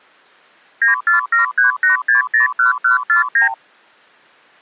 Multi-frequency trunk signalling (R2, with the far end's replies), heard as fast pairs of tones, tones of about 130 ms. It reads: 94738601149